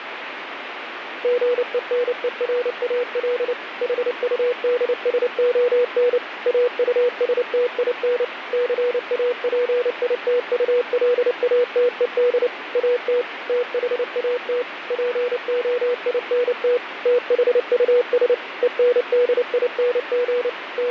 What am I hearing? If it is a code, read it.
Morse code, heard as a keyed tone, machine-sent, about 29 wpm, 490 Hz, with radio static. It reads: GENERAL HUDSON AUSTIN CAPITULATED AT THAT POINT THUS ENDING …